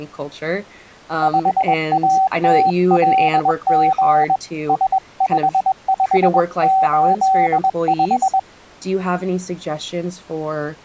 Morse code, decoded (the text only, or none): 5ATLG S5585